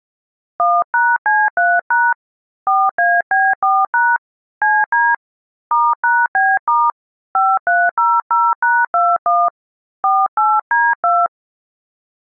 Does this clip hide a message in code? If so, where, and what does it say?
Yes: DTMF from 0.6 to 11.3 s, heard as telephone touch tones, dialled by hand, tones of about 220 ms. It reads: 1#C3# 4AB4# CD *#B* 5300#21 48D2